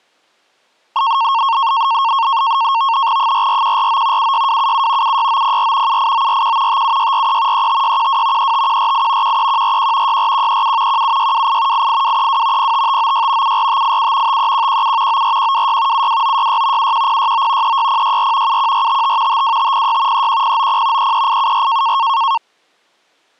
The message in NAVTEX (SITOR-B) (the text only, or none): 44149 76277 76904 78941 57643 35612 35148 13141 64137 17628 88232 05596 74587 53117 94126 72966 71069 36064 71455 52506 31090 33874